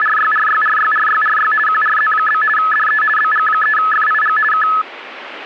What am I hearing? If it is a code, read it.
RTTY (50 baud, 450 Hz shift), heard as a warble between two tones, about 1500 Hz centre. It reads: … QRZ? DE BG3FIG K